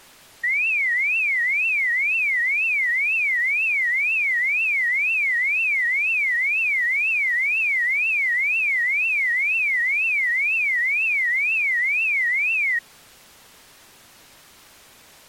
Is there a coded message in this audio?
No, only a tone that sweeps in pitch again and again.